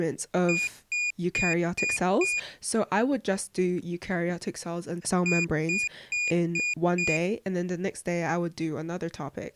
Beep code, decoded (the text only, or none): 5 short